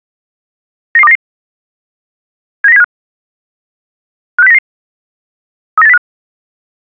Five-tone selective call (EEA), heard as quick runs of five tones, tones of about 40 ms. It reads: 99299 79075 56099 39805